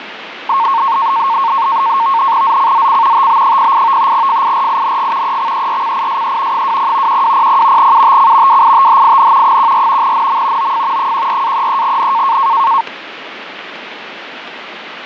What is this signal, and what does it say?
NAVTEX (SITOR-B), 100 baud, 170 Hz shift, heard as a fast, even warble, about 1000 Hz centre, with radio static and fading. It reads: ZCZC TB08 FIRING EXERCISE 20 1200 UTC WITHIN 14 NM OF 14-33N